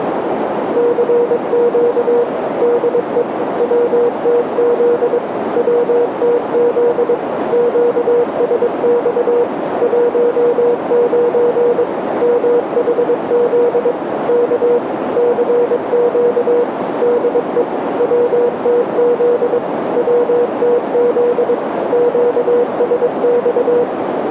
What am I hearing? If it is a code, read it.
Morse code, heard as a keyed tone, machine-sent, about 22 wpm, 480 Hz, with radio static and a narrow filter. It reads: CQ DE WTZ WTZ QSX 19 MHZ K CQ DE WTZ WTZ QSX